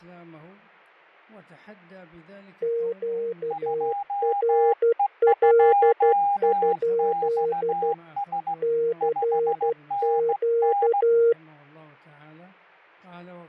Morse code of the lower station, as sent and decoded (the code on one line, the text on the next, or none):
--.- .-. .-.. ..--.. / -.-. --.-
QRL? CQ